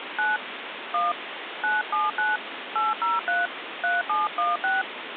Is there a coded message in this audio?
Yes: DTMF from 0.2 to 4.8 s, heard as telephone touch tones, dialled by hand, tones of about 180 ms, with phone line noise. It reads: 9 1 979 803 3716